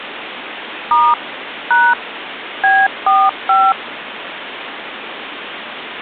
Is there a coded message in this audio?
Yes: DTMF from 0.9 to 3.7 s, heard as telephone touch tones, dialled by machine, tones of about 230 ms, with phone line noise. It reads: * # B45